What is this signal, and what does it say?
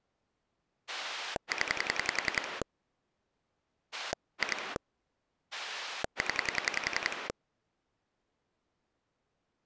Pulse dialling, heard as a rotary dial, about 10 pulses a second. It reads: 0 2 0